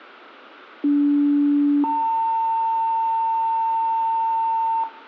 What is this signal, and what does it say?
Two-tone page, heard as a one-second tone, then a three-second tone, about 290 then 900 Hz, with room echo.